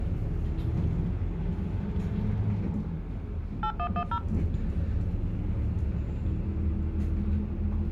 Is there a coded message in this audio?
Yes: DTMF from 3.6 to 4.2 s, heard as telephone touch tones, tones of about 80 ms, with the noise inside a bus. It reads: 8110